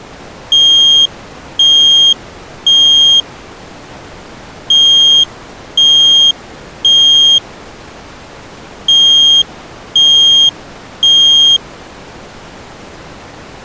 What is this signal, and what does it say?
Alarm pattern, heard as an alarm's beeps, played three times, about 3200 Hz. Temporal three. Smoke or fire, evacuate.